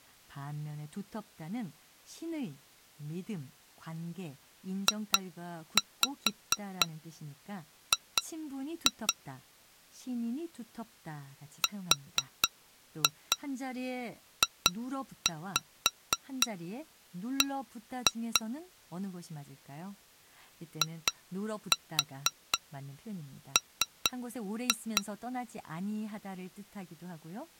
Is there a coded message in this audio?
Yes: tap code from 4.9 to 25.0 s, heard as taps on glass, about 4 knocks a second, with speech in Korean. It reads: JG RJB IM